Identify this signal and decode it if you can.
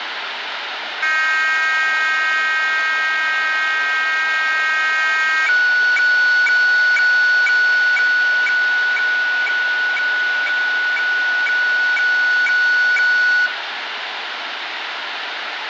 Weather fax (radiofax), 120 lines a minute, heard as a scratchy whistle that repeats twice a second, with radio static.